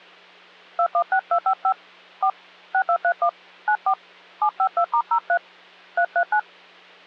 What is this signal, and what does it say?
DTMF, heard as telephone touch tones, dialled by hand, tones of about 80 ms, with hum. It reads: 216255 4 6231 94 752*03 339